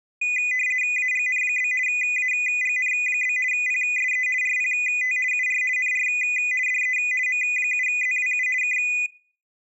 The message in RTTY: AGN? AGN? PSE RPT UR NR DE M7ZWU K

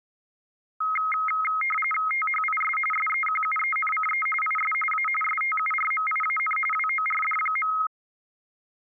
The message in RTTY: THIS SEQUENCE IS A STURMIAN WORD.

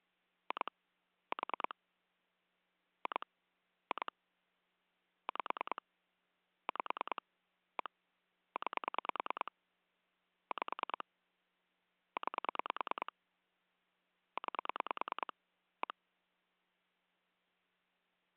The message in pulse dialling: 2 4 2 2 5 5 1 9 5 9 9 1

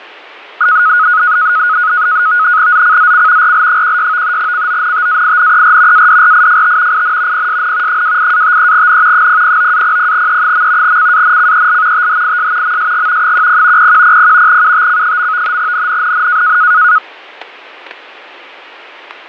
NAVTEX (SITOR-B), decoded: ZCZC RL16 CONTAINER ADRIFT IN PSN 28-53N 009-00E. CANCEL THIS MSG 10 0100 UTC. NNNN

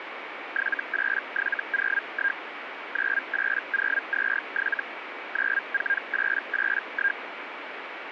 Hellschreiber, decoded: 78701 98027 94881

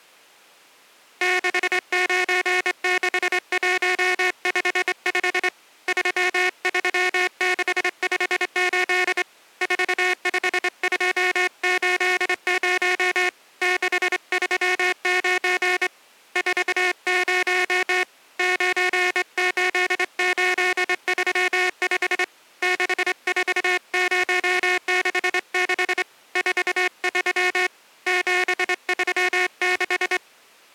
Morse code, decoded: 696155 33658 45280 639 40 98835 64066 43 736

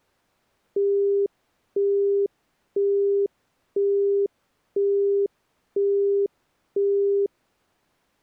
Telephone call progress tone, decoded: busy tone

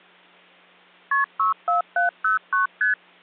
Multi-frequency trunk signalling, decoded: KP 64709 ST

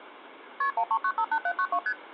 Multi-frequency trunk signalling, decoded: KP 13958792 ST

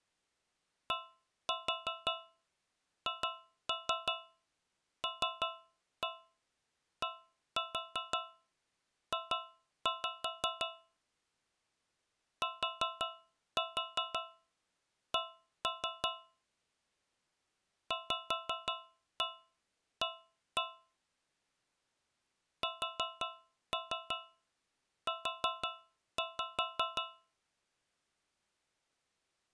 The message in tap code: DHLDJ TC VA SU

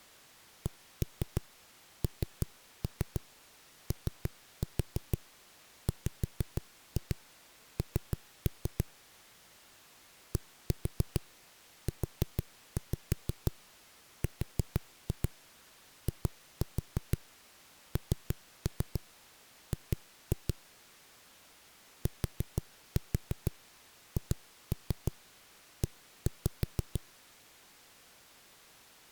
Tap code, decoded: KNOWN DURING THE

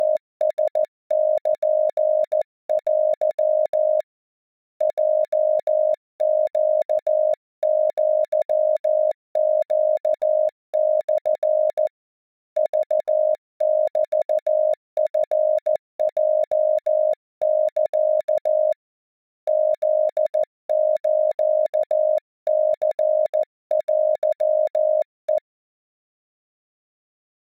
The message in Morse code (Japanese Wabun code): … ヲネアネモ クメチヲサ フスニテヘ

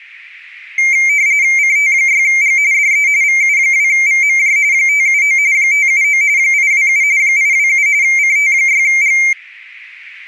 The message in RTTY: CT6G DE VU2VMJ 579 579 827 827 CT6G

